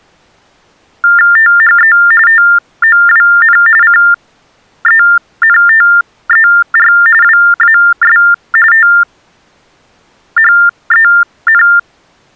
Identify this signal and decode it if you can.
TTY/TDD text telephone tones (45.45 baud Baudot), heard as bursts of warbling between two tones, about 400 Hz shift, 1600 Hz centre. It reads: THE TOWN CENTER WAS THEN